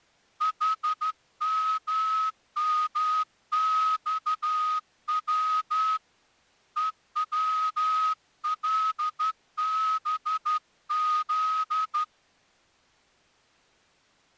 Morse code, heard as a whistle, hand-sent with a straight key, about 12 wpm. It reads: HMMXW EWLBZ